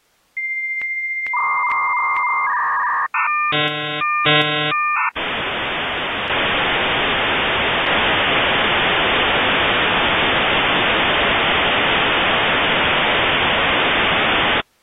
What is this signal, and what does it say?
Dial-up modem handshake (V.34 or later), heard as a whistle, warbles, then hiss.